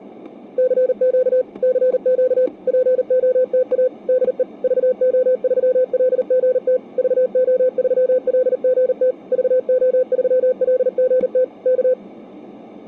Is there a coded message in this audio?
Yes: Morse code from 0.5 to 12.0 s, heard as a keyed tone, machine-sent, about 39 wpm, 510 Hz, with static crashes. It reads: CQ CQ POTA DE VO3LGT VO3LGT VO3LGT K